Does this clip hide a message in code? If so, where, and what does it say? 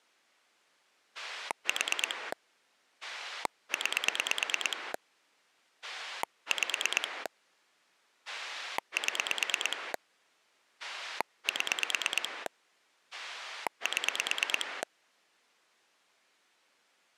Yes: pulse dialling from 1.1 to 14.8 s, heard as a rotary dial, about 9 pulses a second. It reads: 4 9 5 7 7 7